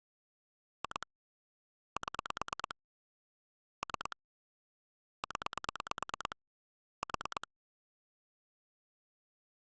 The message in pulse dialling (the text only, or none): 2 7 3 0 4